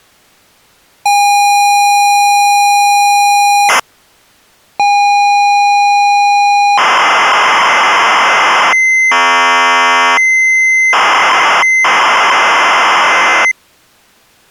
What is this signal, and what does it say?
ZX Spectrum tape loading, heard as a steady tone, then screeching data.